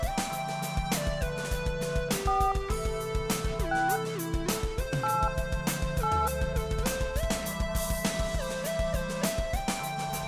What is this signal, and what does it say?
DTMF, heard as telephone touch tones, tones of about 250 ms, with room echo. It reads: 4 6 8 8